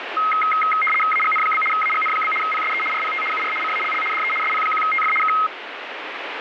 RTTY (75 baud, 850 Hz shift), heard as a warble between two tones, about 1700 Hz centre, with radio static. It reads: AGN? AGN? PSE RPT UR CALL DE SP1TF K